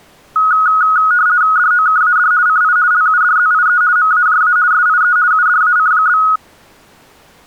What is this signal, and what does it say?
RTTY (50 baud, 170 Hz shift), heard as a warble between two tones, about 1360 Hz centre. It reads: DOKAD CI LUDZIE MAJA SIE UDAC?